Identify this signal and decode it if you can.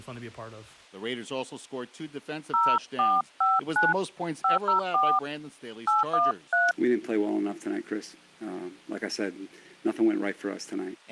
DTMF, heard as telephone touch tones, dialled by hand, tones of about 180 ms. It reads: 0459 504 813